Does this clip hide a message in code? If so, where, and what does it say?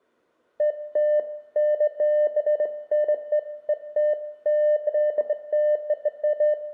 No, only beeps of irregular length, with room echo.